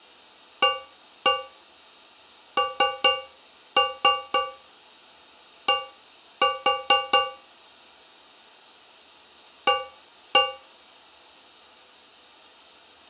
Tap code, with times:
0.6-7.2 AND
9.7-10.4 A

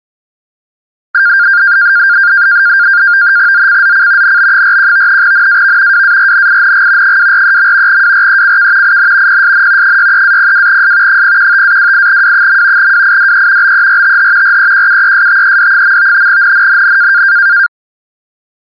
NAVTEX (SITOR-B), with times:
3.5-4.4 ZCZC
4.2-5.2 NB41
5.2-6.0 NAV
5.9-7.2 WARNING
7.0-8.0 243.
7.9-9.0 WRECK
8.8-9.4 IN
9.3-10.0 PSN
9.8-11.2 63-02S
11.1-12.9 015-28W.
12.8-13.7 WIDE
13.6-14.6 BERTH
14.4-16.3 REQUESTED.
16.3-17.2 NNNN

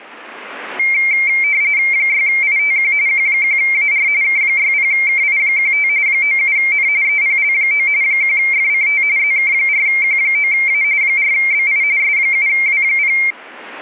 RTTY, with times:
1.9-2.9 6ITQ
3.1-4.1 Q1AR
4.2-5.9 K60KI15
6.1-6.9 97N
7.0-7.9 EPL9
8.0-9.0 1FCT
9.2-10.8 ZK4Q9A
11.0-11.8 4BI
12.0-13.2 S7W0

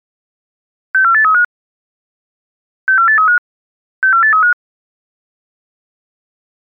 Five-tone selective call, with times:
0.9-1.4 64835
2.9-3.4 64835
4.0-4.5 64835

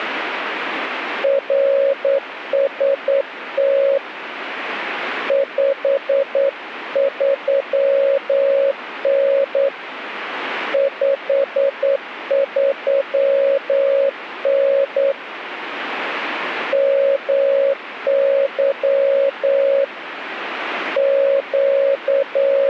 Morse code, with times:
1.2-4.0 RST
5.3-9.7 53N
10.7-15.1 53N
16.7-19.8 MY
21.0-22.7 …

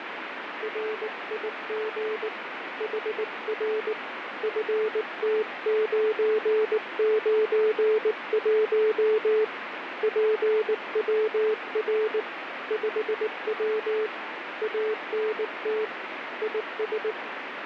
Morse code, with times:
0.6-2.3 RIG
2.8-3.9 HR
4.4-9.4 FT991
10.0-12.2 PWR
12.7-14.1 5W
14.6-15.8 ANT
16.4-17.1 IS

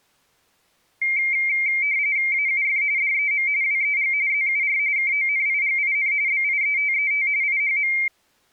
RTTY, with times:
2.3-2.8 AUF
3.0-3.5 DEM
3.6-4.1 WEG
4.3-4.8 ZUR
5.0-6.1 KONIGIN
6.3-7.3 BIETET
7.4-7.9 IHM

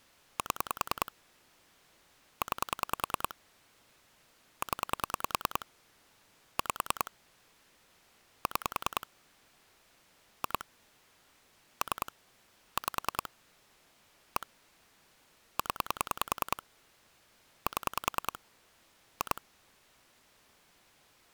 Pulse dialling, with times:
0.4-1.1 7
2.4-3.3 9
4.6-5.7 0
6.6-7.1 5
8.5-9.1 6
10.4-10.6 2
11.8-12.1 3
12.8-13.3 5
14.4-14.5 1
15.6-16.6 0
17.7-18.4 7
19.2-19.4 2

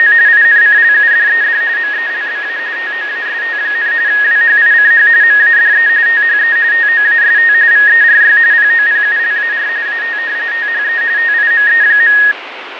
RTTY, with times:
0.0-0.1 …
0.3-1.6 INCLUDED
1.8-2.6 MELBA
2.8-3.9 TOAST,
4.1-5.1 WHICH
5.2-5.9 MADE
6.1-6.6 THE
6.7-7.5 TOAST
7.7-8.4 VERY
8.5-9.7 POPULAR
9.9-10.2 AT
10.5-11.0 THE
11.2-12.2 TIME.

